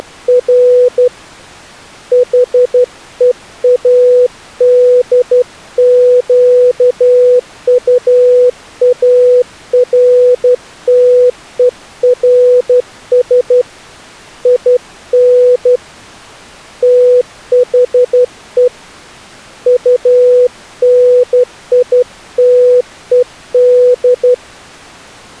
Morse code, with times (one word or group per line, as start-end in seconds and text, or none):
0.0-1.1 …
2.1-13.6 HEADQUARTERS
14.5-15.8 IN
16.8-18.7 THE
19.7-24.3 UNITED